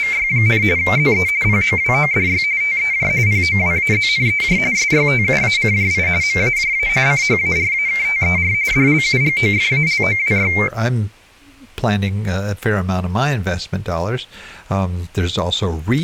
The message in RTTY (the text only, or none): … ZE POWODY TEJ POWAZNEJ SYTUACJI MAJA CHARAKTER DLUGOFALOWY